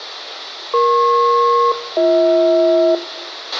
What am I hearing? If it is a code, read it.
Aircraft SELCAL, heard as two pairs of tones, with radio hiss, a squelch burst at the end and room echo. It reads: EP-BH